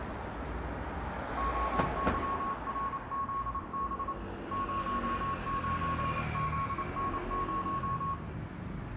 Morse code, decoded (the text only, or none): OYRZB 09ZN0